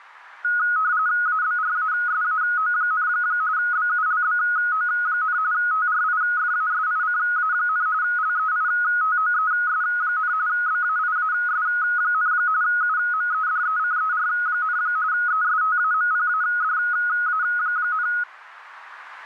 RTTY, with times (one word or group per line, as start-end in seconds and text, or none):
1.3-3.1 ABRASAO,
3.6-5.4 BULBO,
5.5-7.9 TRIFASICA,
8.0-10.3 LEITOES,
10.5-12.3 BAIAS,
12.6-14.8 UMEDECER,
15.1-18.1 ESTAMPADA,